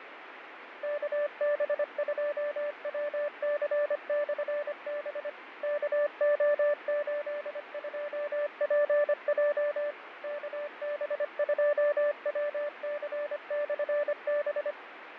Morse code, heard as a keyed tone, machine-sent, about 25 wpm, 590 Hz, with radio static and fading. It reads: KB2WC/B KO82PJ KB2WC/B